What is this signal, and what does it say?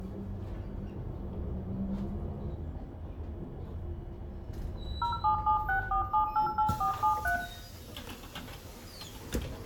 DTMF, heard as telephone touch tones, dialled by machine, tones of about 110 ms, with room echo and the noise inside a bus. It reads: 07764788473